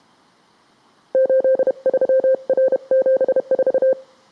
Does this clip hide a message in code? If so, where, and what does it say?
Yes: Morse code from 1.1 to 4.0 s, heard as a keyed tone, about 31 wpm, 520 Hz. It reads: 83R74